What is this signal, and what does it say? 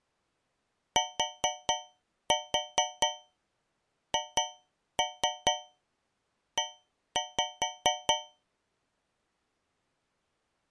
Tap code, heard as taps on a metal pipe, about 4 knocks a second. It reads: THE